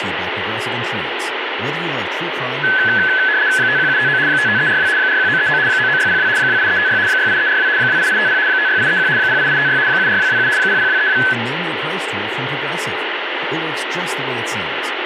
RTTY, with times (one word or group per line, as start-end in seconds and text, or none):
3.6-4.2 51759
4.3-4.9 55342
5.0-5.6 41939
5.7-6.3 99602
6.4-7.0 28356
7.1-7.7 68342
7.8-8.4 28850
8.5-9.1 56831
9.2-9.8 08856
9.9-10.5 74227
10.6-11.2 00232